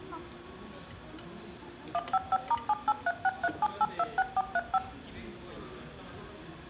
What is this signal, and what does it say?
DTMF, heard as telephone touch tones, dialled by machine, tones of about 40 ms, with room echo and the noise of a restaurant. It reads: 155*783637826435